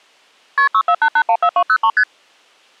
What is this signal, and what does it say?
Multi-frequency trunk signalling (R1, as on North American trunks), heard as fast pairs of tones, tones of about 70 ms. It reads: KP 648814203 ST